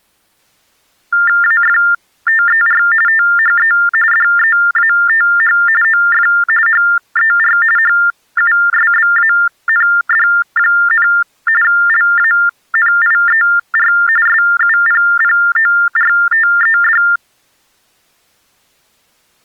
TTY/TDD text telephone tones (45.45 baud Baudot), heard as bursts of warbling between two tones, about 400 Hz shift, 1600 Hz centre. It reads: AFTER THE DEATH OF HER HUSBAND, LANIER SUPPORTED